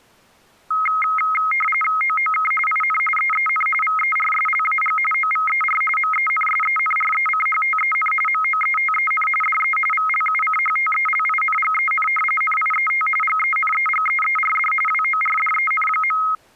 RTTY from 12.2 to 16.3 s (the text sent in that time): NIET GENEGEERD WORDEN.